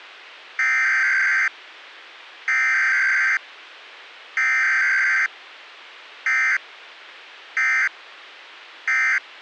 Emergency Alert System (SAME) tones (header bursts, then end-of-message bursts), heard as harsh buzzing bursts, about 520.83 baud.